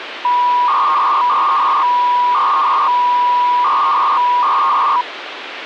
300-baud modem data (V.21 tones), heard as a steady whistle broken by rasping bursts, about 300 baud, 200 Hz shift, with phone line noise.